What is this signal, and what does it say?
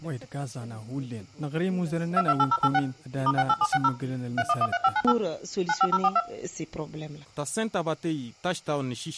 DTMF, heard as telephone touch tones, dialled by machine, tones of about 50 ms. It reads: 228086 *68760 3113598 95042